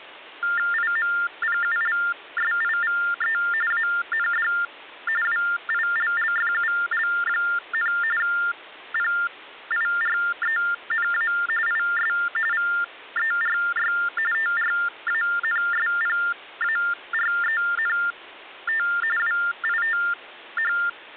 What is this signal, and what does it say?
TTY/TDD text telephone tones (45.45 baud Baudot), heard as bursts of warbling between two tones, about 400 Hz shift, 1600 Hz centre. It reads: IMPULSIVE AND WILLFUL, PIRENA IS VERY TRANSPARENT WITH